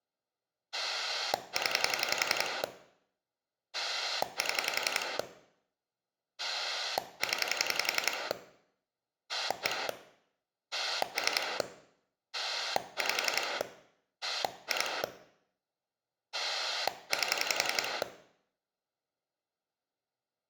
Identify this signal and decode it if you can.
Pulse dialling, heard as a rotary dial, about 11 pulses a second, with room echo. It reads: 0 7 0 1 3 5 2 8